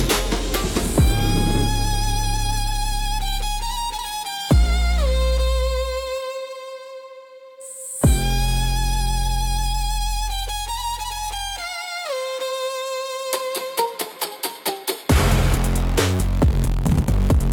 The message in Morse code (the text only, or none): none